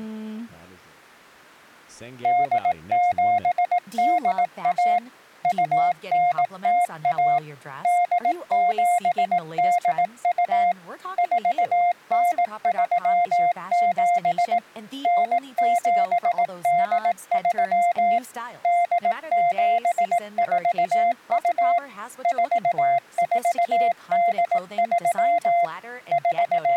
Morse code (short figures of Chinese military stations), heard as a keyed tone, machine-sent, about 18 wpm, 700 Hz, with speech in English. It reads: 8781 2901 8782 4937 9783 8742 4483 …